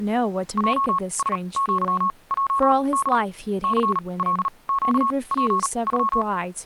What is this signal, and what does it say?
Morse code (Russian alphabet), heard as a keyed tone, machine-sent, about 38 wpm, spaced as for 26 wpm, 1100 Hz, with speech in English. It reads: ЙСЪЙД ЦЛЩПЮ